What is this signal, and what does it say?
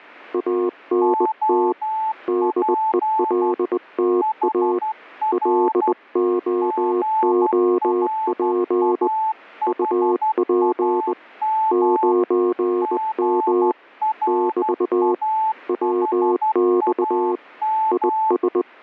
Morse code, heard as two keyed tones. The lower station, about 20 wpm, 360 Hz: ANT DELTA LOOP UP 9M <BT> WX IS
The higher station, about 12 wpm, 880 Hz: OP HR GRAHAM GRAHAM